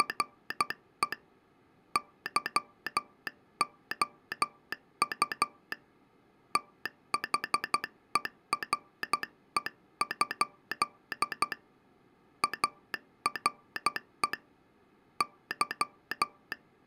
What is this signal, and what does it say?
Morse code, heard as a telegraph sounder, hand-sent with a paddle, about 12 wpm. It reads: … YOU THERE? ARE …